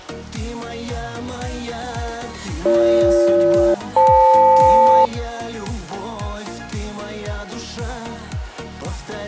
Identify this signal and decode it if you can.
Aircraft SELCAL, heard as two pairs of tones. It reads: BG-FL